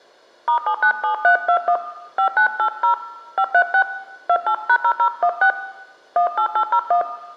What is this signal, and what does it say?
DTMF, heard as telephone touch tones, dialled by hand, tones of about 80 ms, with room echo. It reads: *797321 5980 536 28#0016 18801